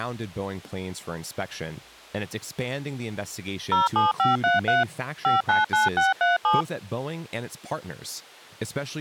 DTMF, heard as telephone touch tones, dialled by machine, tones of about 160 ms, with speech in English. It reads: 07533 599637